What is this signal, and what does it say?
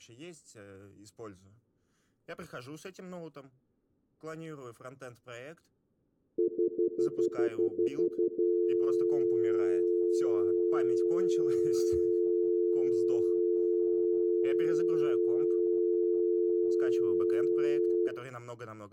Telephone call progress tone (North American plan), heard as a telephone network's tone, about 350, 440 Hz, 0.1 s on and 0.1 s off, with room echo and speech in Russian. Stutter dial tone.